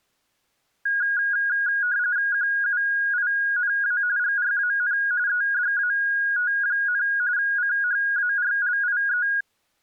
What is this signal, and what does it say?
RTTY (45.45 baud, 170 Hz shift), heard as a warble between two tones, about 1550 Hz centre. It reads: QUINA GRAN EDAT, CHARLIE